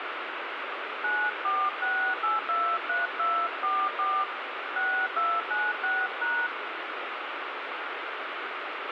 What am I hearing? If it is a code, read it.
DTMF, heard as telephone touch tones, dialled by hand, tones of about 230 ms, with radio hiss and a squelch burst at the end. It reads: 946823244 6296#